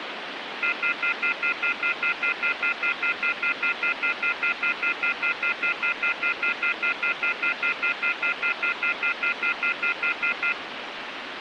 Telephone call progress tone (North American plan), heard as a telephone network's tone, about 1400, 2050, 2450, 2600 Hz, 0.1 s on and 0.1 s off, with phone line noise. Off-hook warning tone.